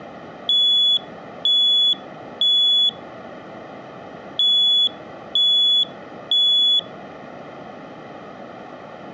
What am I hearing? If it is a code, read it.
Alarm pattern, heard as an alarm's beeps, played twice, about 3400 Hz. Temporal three. Smoke or fire, evacuate.